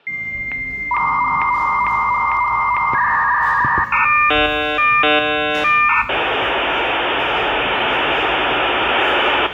Dial-up modem handshake (V.34 or later), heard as a whistle, warbles, then hiss, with hum, room echo and the noise of a cafe.